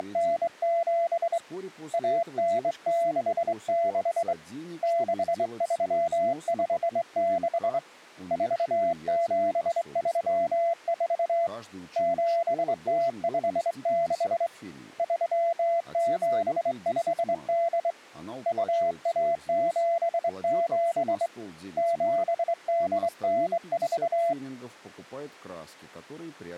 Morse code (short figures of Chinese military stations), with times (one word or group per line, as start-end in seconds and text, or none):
0.0-1.4 …
1.9-4.3 1966
4.8-7.8 6356
8.3-11.5 4734
12.0-14.5 7056
15.0-17.9 3758
18.5-21.3 2177
21.8-24.3 7894